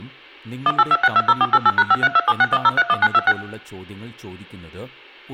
DTMF, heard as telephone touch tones, dialled by machine, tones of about 40 ms, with speech in Malayalam. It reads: 182620488#532761031926